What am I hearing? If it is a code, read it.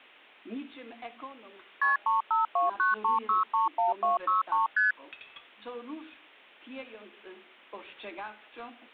Multi-frequency trunk signalling (R1, as on North American trunks), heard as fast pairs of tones, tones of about 140 ms. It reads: KP 35293631263 ST